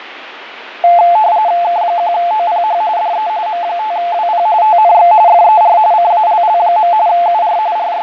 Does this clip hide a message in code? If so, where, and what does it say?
Yes: RTTY (45.45 baud, 170 Hz shift) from 0.8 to 8.0 s, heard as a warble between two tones, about 780 Hz centre, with radio static and fading. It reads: K1OPH DE M5WP TNX FER CALL. UR …